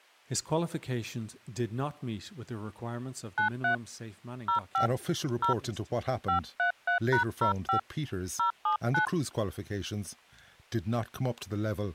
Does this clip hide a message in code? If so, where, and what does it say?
Yes: DTMF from 3.4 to 9.1 s, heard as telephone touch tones, dialled by hand, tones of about 110 ms, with speech in English. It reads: 93 05 0 533#05 079